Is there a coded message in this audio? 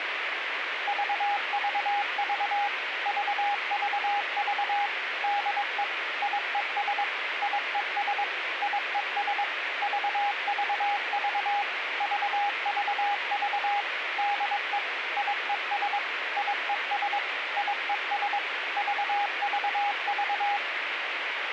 Yes: Morse code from 0.8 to 20.6 s, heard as a keyed tone, machine-sent, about 22 wpm, 820 Hz, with radio hiss. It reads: VVV VVV DE IES IES IES VVV VVV DE IES IES IES VVV